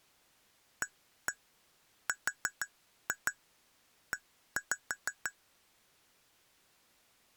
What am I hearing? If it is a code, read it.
Tap code, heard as taps on glass, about 6 knocks a second. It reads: ARE